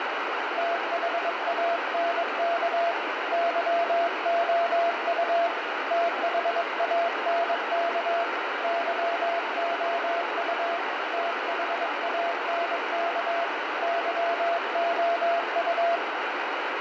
Morse code, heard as a keyed tone, hand-sent with a paddle, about 22 wpm, 680 Hz, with heavy radio static. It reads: THANK YOU THANK YOU THANK YOU